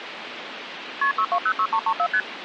Multi-frequency trunk signalling (R1, as on North American trunks), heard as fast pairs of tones, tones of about 70 ms, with phone line noise. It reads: KP 6206334 ST